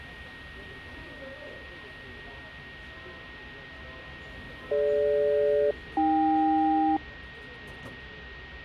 Aircraft SELCAL, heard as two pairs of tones, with radio static, a steady whistle near 1870 Hz and the noise of a subway station. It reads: DG-AK